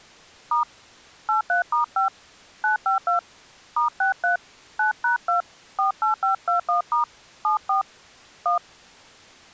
DTMF, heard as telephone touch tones, dialled by hand, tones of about 120 ms. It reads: * 83*5 952 *63 9#2 48521* 74 1